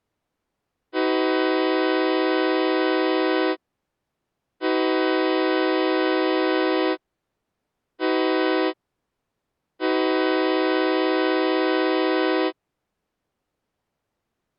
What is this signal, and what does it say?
Train horn signal, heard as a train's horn. 2 long, 1 short, 1 long. On North American railways: approaching a public crossing.